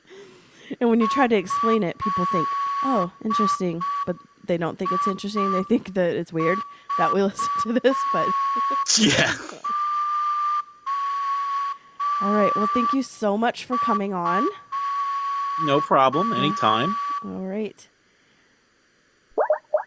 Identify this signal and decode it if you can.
Morse code (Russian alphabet), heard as a whistle, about 5 wpm, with room echo and speech in English. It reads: ЭИЖОЮ